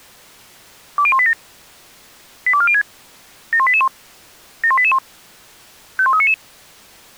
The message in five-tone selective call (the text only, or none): 20187 82406 71881 71881 51399